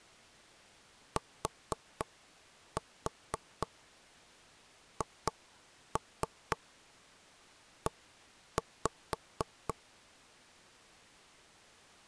Tap code, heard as knocks on wood, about 4 knocks a second. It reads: THE